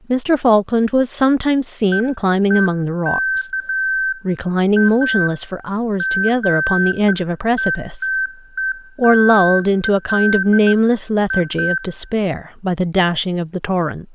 Beeps of irregular length, with room echo and speech in English. There is no code.